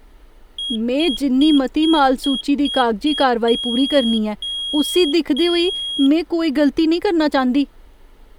Beep code, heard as a piezo beeper, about 3300 Hz, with speech in Dogri. 7 short, 3 long.